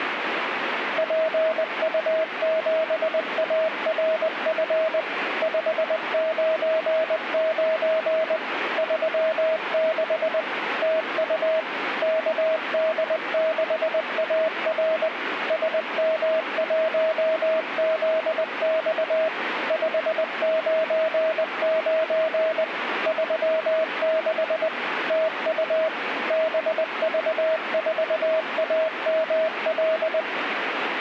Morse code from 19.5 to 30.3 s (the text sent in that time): 599 36 TU BV4AML